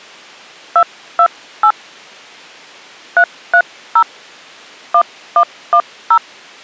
DTMF, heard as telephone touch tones, dialled by hand, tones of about 70 ms. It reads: 228 330 1110